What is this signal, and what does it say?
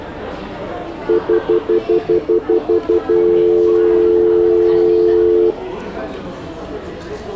Telephone call progress tone (North American plan), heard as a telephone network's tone, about 350, 440 Hz, 0.1 s on and 0.1 s off, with the noise of a restaurant. Stutter dial tone.